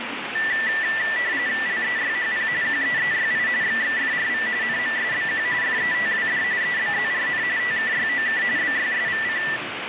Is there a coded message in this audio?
Yes: RTTY (45.45 baud, 170 Hz shift) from 0.4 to 9.6 s, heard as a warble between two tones, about 1850 Hz centre, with radio static and the noise of a crowd indoors. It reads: LEYHP QEEYI XXFRV NMSBQ FETWD EBZRN TKYOK BYSVC